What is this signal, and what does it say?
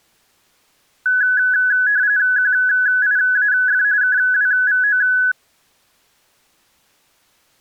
RTTY (45.45 baud, 170 Hz shift), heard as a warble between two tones, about 1600 Hz centre. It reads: QIAF KWVO